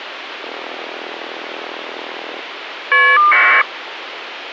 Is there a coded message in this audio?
Yes: caller ID data burst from 0.4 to 3.6 s, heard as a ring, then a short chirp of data, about 1200 baud, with phone line noise.